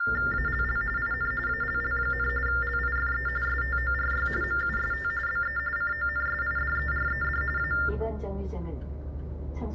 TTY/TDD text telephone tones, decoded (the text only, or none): ALL IN ALL, LIFE STORY MUST BE CONSIDERED A